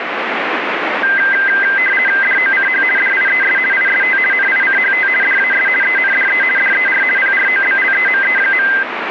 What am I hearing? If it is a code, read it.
RTTY (50 baud, 450 Hz shift), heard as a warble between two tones, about 1800 Hz centre, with radio static. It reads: DOCH DIES IST NICHT DAS ENDE DER PROBLEME.